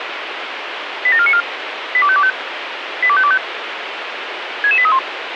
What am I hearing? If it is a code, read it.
Five-tone selective call (ZVEI), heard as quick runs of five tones, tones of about 70 ms, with radio hiss. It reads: 87494 82525 82525 66831